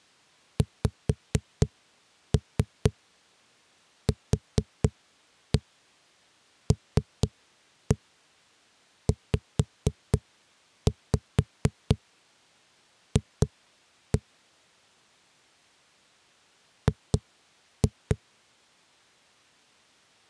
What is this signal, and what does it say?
Tap code, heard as knocks on a wall, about 4 knocks a second. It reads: XQLZF G